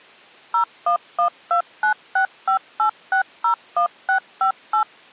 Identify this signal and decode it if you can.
DTMF, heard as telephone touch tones, dialled by machine, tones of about 100 ms. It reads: 01129658601658